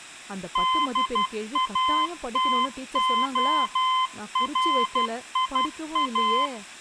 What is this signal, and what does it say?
Morse code, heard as a keyed tone, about 12 wpm, 1030 Hz, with speech in Tamil. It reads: DATORIA